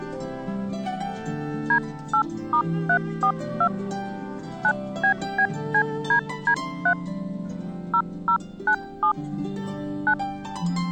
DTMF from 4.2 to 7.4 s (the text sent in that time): 9BBCDD3